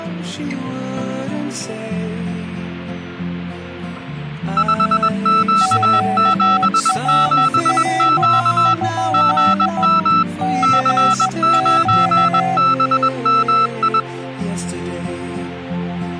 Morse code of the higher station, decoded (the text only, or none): 5Q77Q GM C9BMI